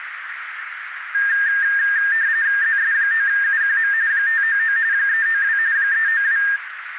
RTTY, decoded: ZS9UQM 599 392 392

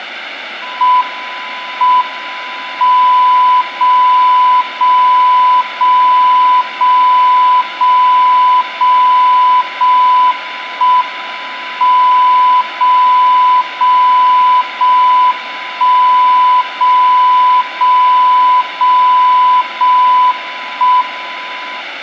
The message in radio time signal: M M 0 0 0 0 0 0 0 1 M 0 0 0 1 0 0 0 0 1 M

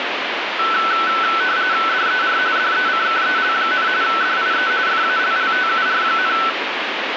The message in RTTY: DER DECKEL, DIE FALLTUR,

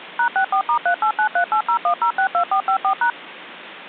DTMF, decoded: #64*3893801062454#

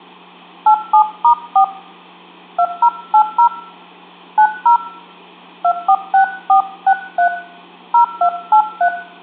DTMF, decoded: 87*4 2080 90 246463 0283

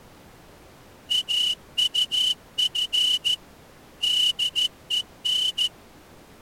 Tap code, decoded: none

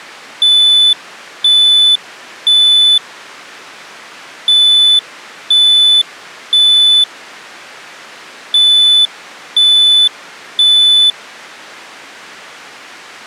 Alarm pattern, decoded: temporal three

